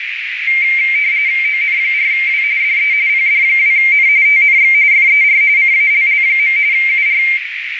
RTTY (45.45 baud, 170 Hz shift), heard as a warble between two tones, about 2200 Hz centre, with radio static and a narrow filter. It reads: ON4W DE PD2N TNX FER CALL. UR